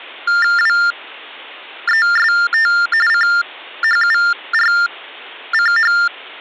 TTY/TDD text telephone tones (45.45 baud Baudot), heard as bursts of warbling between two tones, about 400 Hz shift, 1600 Hz centre. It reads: WEST CHURCH